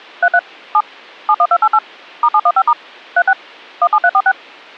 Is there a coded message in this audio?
Yes: DTMF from 0.2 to 4.3 s, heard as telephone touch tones, dialled by machine, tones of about 60 ms. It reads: 33 7 71288 *715* 36 17346